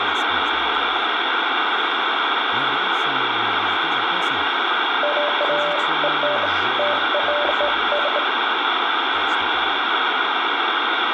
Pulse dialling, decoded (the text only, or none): none